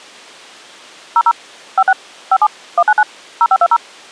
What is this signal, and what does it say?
DTMF, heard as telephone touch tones, dialled by machine, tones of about 50 ms. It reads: 00 56 57 199 0520